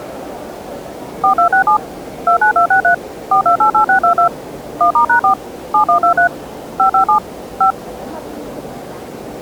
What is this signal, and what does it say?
DTMF, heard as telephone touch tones, dialled by machine, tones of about 100 ms, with the noise of a crowd indoors. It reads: 4267 29263 4288622 1*#4 7123 557 5